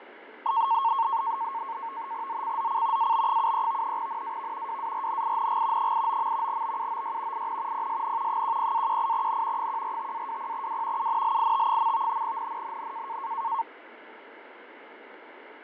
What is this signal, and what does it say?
NAVTEX (SITOR-B), 100 baud, 170 Hz shift, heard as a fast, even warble, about 1000 Hz centre, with radio static and fading. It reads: ZCZC AB73 NAV WARNING 89. BUOY IN PSN 10-18N 145-20W UNLIT. NNNN